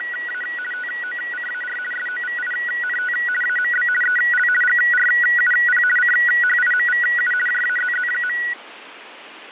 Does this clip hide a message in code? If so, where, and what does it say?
Yes: RTTY (50 baud, 450 Hz shift) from 0.0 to 8.5 s, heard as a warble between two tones, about 1700 Hz centre, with radio static and fading. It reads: … TOCAR SOVINT AMB EL GRUP CHIMVU JAZZ.